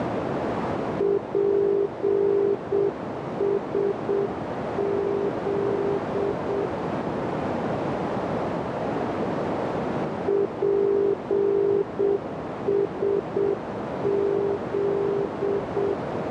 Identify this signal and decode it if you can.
Morse code, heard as a keyed tone, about 7 wpm, 400 Hz, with heavy radio static and a narrow filter. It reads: PSZ PSZ